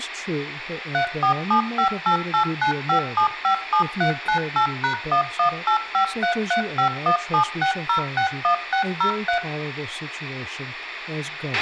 DTMF, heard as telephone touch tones, dialled by machine, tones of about 100 ms, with a squelch burst at the end, room echo and speech in English. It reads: 34758895757398#1185335176061603